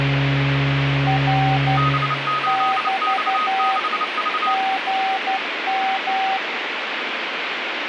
Morse code, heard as two keyed tones, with radio static. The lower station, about 12 wpm, 770 Hz: R <BT> GM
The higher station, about 29 wpm, 1250 Hz: B8X6V